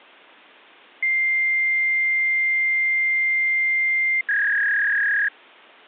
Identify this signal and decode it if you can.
Fax machine handshake, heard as a long tone and a warble.